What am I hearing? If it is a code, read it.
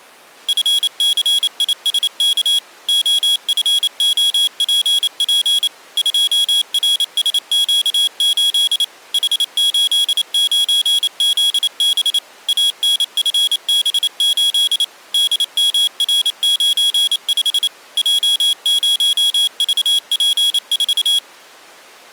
Morse code, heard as a high beeper, machine-sent, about 28 wpm, 3350 Hz. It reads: FCISK OFOPP 2RSQ8 H89ZB ANFB8 DMR95 J0VP4